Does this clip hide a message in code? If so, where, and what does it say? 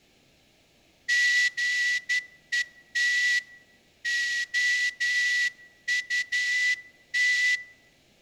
Yes: Morse code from 1.0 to 7.6 s, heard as a whistle, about 12 wpm, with room echo. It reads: GET OUT